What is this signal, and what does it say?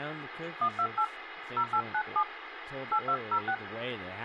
DTMF, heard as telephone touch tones, dialled by hand, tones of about 70 ms, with phone line noise and speech in English. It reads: 128 0897 8206